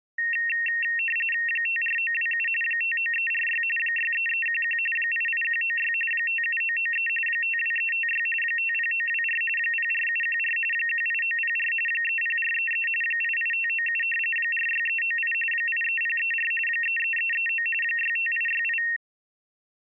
RTTY (45.45 baud, 850 Hz shift), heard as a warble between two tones, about 2300 Hz centre. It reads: 54927 59346 63311 88196 57993 52356 50924 04714 18904 30433 88597 46398 83034 33339 65868